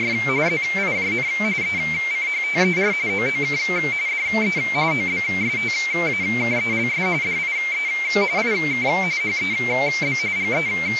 RTTY (45.45 baud, 170 Hz shift), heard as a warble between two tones, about 2200 Hz centre, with radio static. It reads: … ZIJN ECHTER OOK DE OBSTAKELS DIE IK HEB …